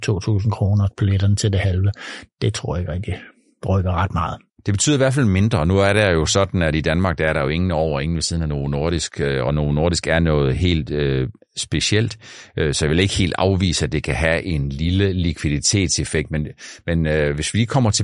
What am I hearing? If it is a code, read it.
Speech in Danish. There is no code.